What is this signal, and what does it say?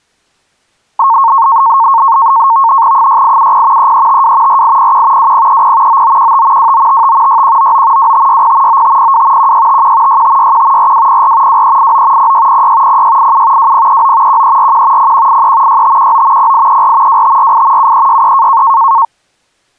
NAVTEX (SITOR-B), 100 baud, 170 Hz shift, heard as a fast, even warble, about 1000 Hz centre. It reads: 6870 3352 4801 2030 9915 2955 6199 2560 9502 1651 6561 4204 2389 0606 0687 2039 1341 0183 6519 0834 2548 7363